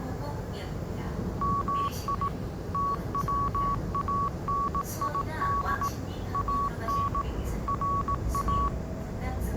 Morse code (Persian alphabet), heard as a keyed tone, machine-sent, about 18 wpm, 1120 Hz, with the noise inside a subway train. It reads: می توانید ان را